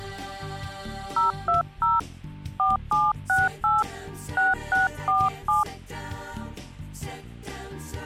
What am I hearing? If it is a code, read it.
DTMF, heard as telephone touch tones, dialled by hand, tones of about 170 ms. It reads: 020 4768 6647